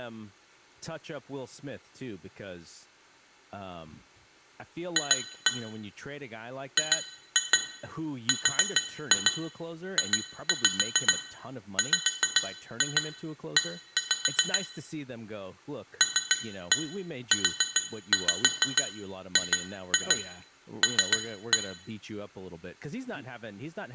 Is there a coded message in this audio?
Yes: tap code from 5.0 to 21.7 s, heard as taps on glass, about 7 knocks a second, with room echo and speech in English. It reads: F GRJWE LUGL